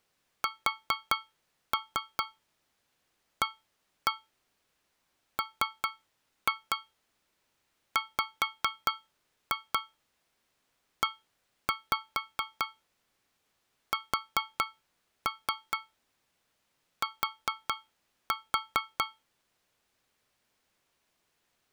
Tap code, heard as taps on a metal pipe, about 4 knocks a second. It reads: SAMWEST